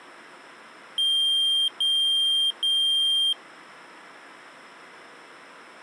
Beep code, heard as a piezo beeper, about 3200 Hz. 3 long. In IBM BIOS tables: keyboard card error.